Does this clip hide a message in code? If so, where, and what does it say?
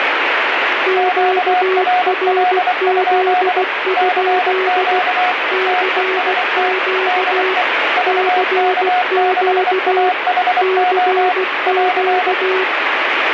Yes: Morse code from 0.8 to 12.7 s, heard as two keyed tones, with heavy radio static. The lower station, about 16 wpm, 380 Hz: QRZ? CQ CQ CQ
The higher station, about 24 wpm, 730 Hz: QRL? CQ TEST DE VK6AHO <AR>